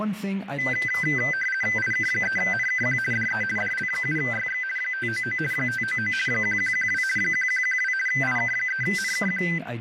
RTTY (50 baud, 450 Hz shift), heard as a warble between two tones, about 1800 Hz centre, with radio static and speech in English. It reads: IK3NKQ DE DL7YX 599 599 1112 1112 IK3NKQ